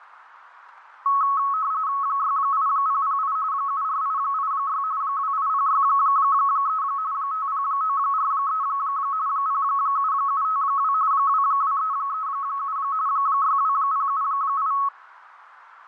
RTTY (45.45 baud, 170 Hz shift), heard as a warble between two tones, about 1200 Hz centre, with radio static and fading. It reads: 68008 74886 28063 50943 07752 22337 62078